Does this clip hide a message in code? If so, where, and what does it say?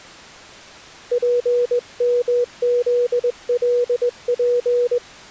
Yes: Morse code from 1.1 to 5.0 s, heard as a keyed tone, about 21 wpm, 490 Hz. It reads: PMZLP